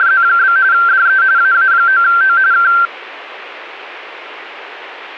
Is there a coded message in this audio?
Yes: RTTY (45.45 baud, 170 Hz shift) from 0.0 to 2.9 s, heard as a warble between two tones, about 1470 Hz centre. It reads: … DE AA9O K